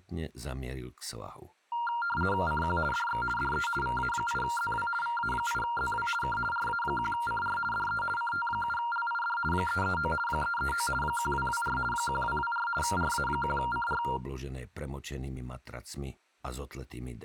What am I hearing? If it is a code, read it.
RTTY (50 baud, 450 Hz shift), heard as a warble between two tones, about 1170 Hz centre. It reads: CQ DX DE VA8ZW VA8ZW K RA1CR DE CT7LID 339 339 1224 1224 RA1CR